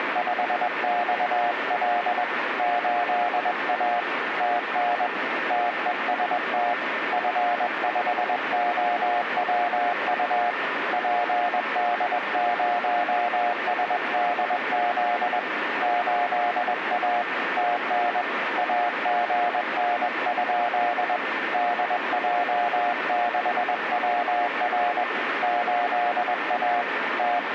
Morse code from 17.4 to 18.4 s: TN

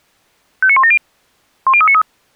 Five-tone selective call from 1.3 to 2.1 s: 10393

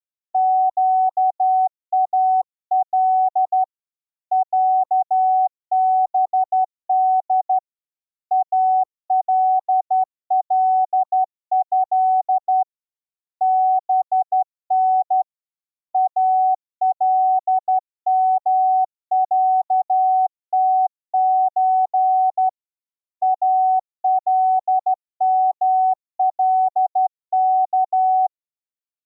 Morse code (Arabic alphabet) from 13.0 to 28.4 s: بن المعتز الملك

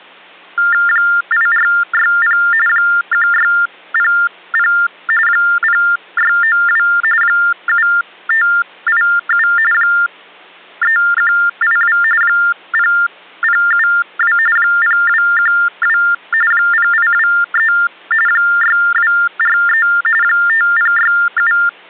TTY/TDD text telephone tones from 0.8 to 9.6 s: 8460 1600 0692 7587

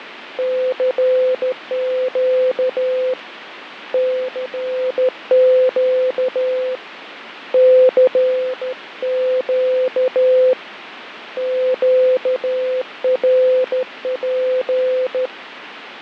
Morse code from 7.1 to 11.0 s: CQ

